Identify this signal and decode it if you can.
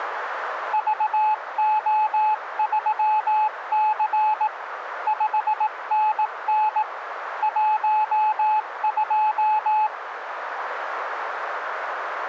Morse code, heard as a keyed tone, hand-sent with a paddle, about 18 wpm, 860 Hz, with radio static. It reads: VO3C 5NN 12